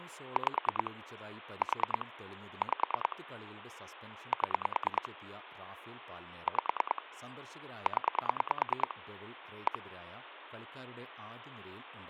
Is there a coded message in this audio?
Yes: pulse dialling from 0.4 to 9.8 s, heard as clicks on a phone line, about 9 pulses a second, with phone line noise and speech in Malayalam. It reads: 5 4 5 7 5 0 1